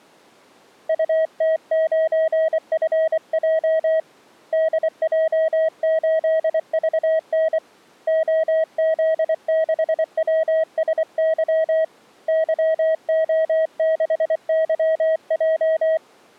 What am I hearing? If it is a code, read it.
Morse code, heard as a keyed tone, hand-sent with a paddle, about 24 wpm, 640 Hz. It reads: UT9FJ DJ8VN OZ6WSY YO6YJ